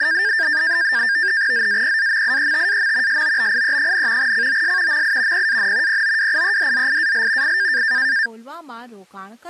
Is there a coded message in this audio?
Yes: NAVTEX (SITOR-B), 100 baud, 170 Hz shift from 0.0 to 8.3 s, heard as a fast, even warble, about 1700 Hz centre, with speech in Gujarati. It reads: ZAPAMIETAM SOBIE, COS MI PAN POWIEDZIAL I